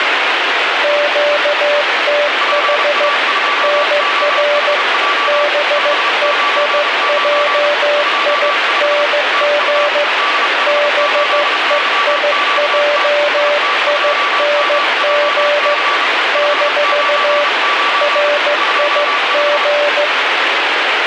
Morse code, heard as two keyed tones, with heavy radio static. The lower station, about 15 wpm, 590 Hz: QTH NR BEIJING BEIJING - RIG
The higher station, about 32 wpm, 1160 Hz: PA2OHJ 599 25 TU DH8YQT IT2MJC 599 25